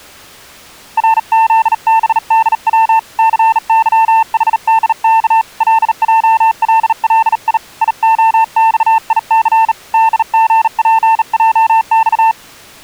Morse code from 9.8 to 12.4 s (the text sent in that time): DGPJX